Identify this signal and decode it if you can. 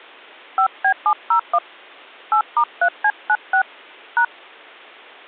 DTMF, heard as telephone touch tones, dialled by hand, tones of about 80 ms. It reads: 5B701 8*3C96 #